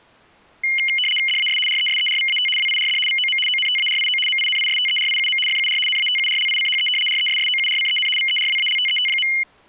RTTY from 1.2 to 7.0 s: DAS RESERVAT WIRD VOM ONTARIO MINISTERIUM FUR NATURLICHE

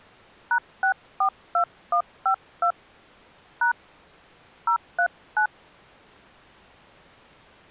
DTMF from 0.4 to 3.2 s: #642152

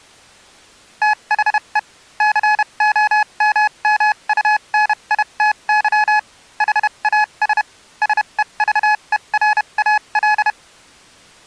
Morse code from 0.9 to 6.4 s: THE COMMUNITY

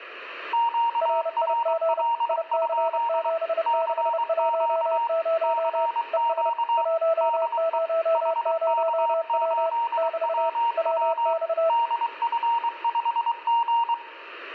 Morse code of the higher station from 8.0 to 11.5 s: HK8WW

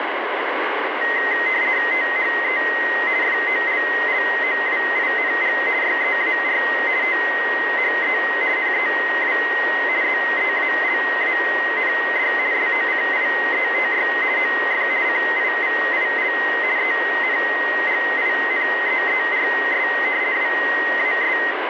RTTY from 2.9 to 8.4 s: FOLLOWING YEAR THE

